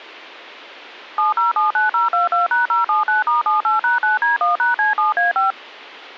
DTMF, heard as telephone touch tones, dialled by machine, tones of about 140 ms. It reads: 7079022#079*78#9D1#C7A5